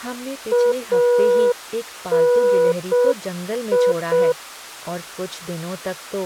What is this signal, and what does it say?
Morse code (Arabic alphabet), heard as a keyed tone, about 6 wpm, 490 Hz, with speech in Hindi. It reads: اني